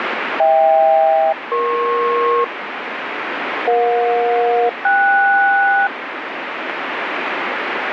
Aircraft SELCAL, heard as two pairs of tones, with radio static. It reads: HK-EP EJ-KS